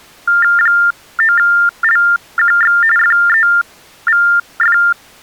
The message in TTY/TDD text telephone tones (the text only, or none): 9LQX FEVF